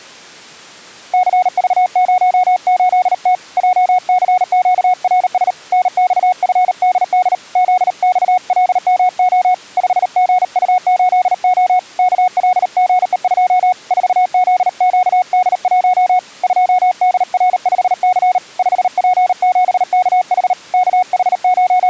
Morse code, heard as a keyed tone, hand-sent with a paddle, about 38 wpm, 730 Hz. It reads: CV08T JCQRS NXFDD ZXLMO 5GU8O KLGE2 4ZQD1 2DR5C 5P7KH …